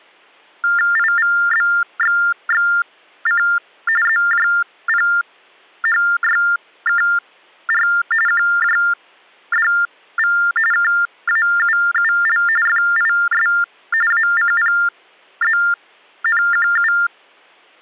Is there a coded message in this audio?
Yes: TTY/TDD text telephone tones (45.45 baud Baudot) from 0.6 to 17.1 s, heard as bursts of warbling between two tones, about 400 Hz shift, 1600 Hz centre. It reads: IVBXXC ZJPHYKR QJDV KAUUL FIS ACPZNQU